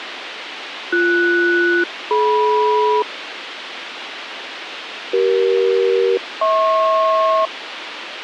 Aircraft SELCAL, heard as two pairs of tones, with radio hiss and a squelch burst at the end. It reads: BS-DM CE-HP